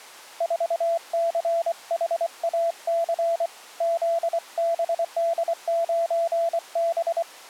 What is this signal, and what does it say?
Morse code, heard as a keyed tone, hand-sent with a paddle, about 24 wpm, 670 Hz. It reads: 4CHAC ZBD9B